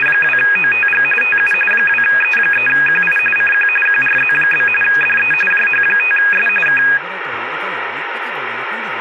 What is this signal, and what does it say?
RTTY (45.45 baud, 850 Hz shift), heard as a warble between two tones, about 2050 Hz centre, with radio static and speech in Italian. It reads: … TU 2E3QI CQ QRZ? DE JH5S K